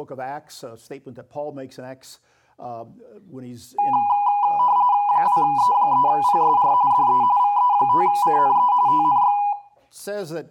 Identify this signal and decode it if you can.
RTTY (45.45 baud, 170 Hz shift), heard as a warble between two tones, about 900 Hz centre, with room echo. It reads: 2E3PSR DE VE5CNE TNX